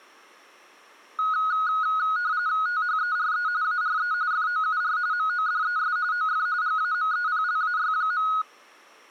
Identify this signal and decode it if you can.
RTTY (45.45 baud, 170 Hz shift), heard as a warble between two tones, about 1360 Hz centre. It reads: THERE ARE FOUR MODES OF GAMEPLAY.